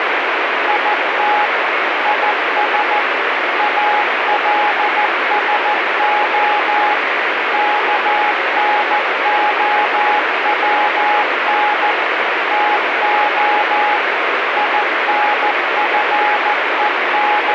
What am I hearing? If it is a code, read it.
Morse code, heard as a keyed tone, machine-sent, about 14 wpm, 840 Hz, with heavy radio static. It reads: IT IS ALSO KNOWN TO …